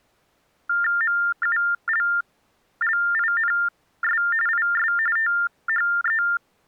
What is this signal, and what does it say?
TTY/TDD text telephone tones (45.45 baud Baudot), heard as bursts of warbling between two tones, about 400 Hz shift, 1600 Hz centre. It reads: MULLINS IS THE